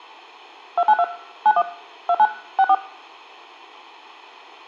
DTMF, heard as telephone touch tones, dialled by machine, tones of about 60 ms. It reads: 292 91 29 64